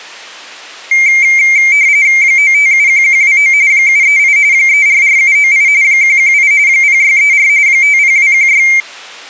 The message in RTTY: 9571129 738 344798 118 0634 50216

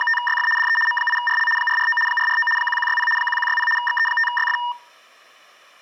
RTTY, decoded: … DE M8RL 449 449 1160 1160 XE5YF

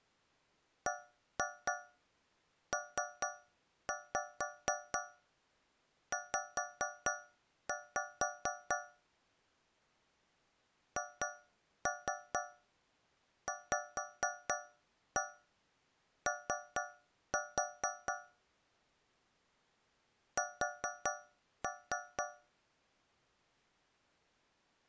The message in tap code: BPZ HVO S

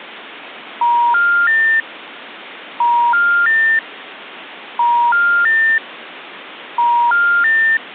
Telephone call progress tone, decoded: special information tone

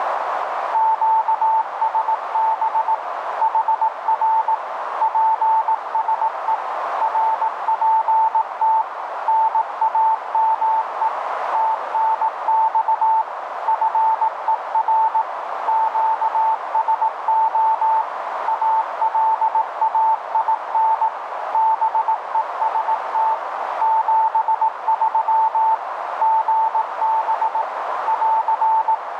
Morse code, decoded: QSB HR PSE RPT NAME TNX FER QSO ALAIN BEST 73 GB <AR>

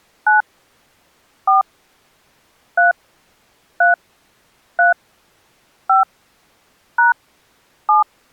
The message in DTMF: 9 4 3 3 3 5 # 7

